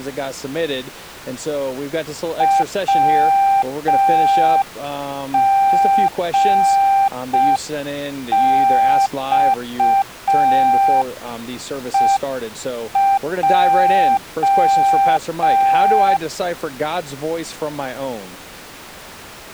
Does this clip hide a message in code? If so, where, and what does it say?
Yes: Morse code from 2.3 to 16.2 s, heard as a keyed tone, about 5 wpm, 790 Hz. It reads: WGXEJ